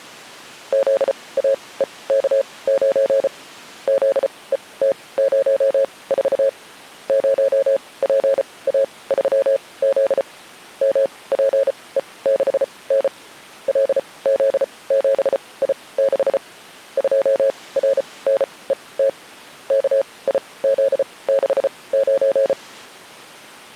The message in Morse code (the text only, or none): ZAEK9 ZET04 0PA3Z MPE6N LZ7I6 2RNET KIZ69